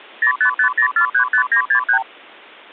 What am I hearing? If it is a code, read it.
Multi-frequency trunk signalling (R2, with the far end's replies), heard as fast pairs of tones, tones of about 90 ms. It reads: 0550435963